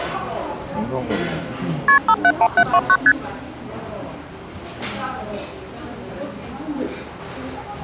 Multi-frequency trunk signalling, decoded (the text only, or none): KP 571729 ST